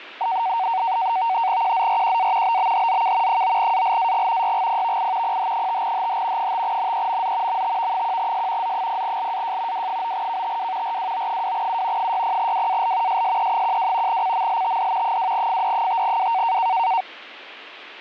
NAVTEX (SITOR-B), 100 baud, 170 Hz shift, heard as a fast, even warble, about 840 Hz centre. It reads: QZRQA BBHZK 9ALAG YGPVI PH5HH 5NEMZ MTV1S Z0LAJ W9KTW RWO2U 60WAL SSE12 CMLTD 2FD5W